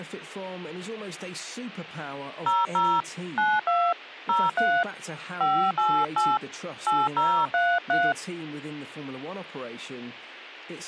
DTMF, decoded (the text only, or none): 00 92 03 588 8033